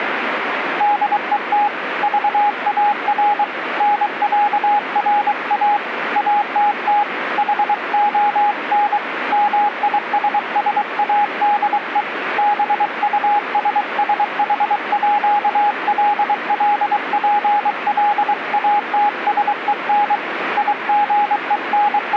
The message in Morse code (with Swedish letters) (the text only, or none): DET VAR NÄRA ATT HON MISSADE BUSSHÅLLPLATSEN …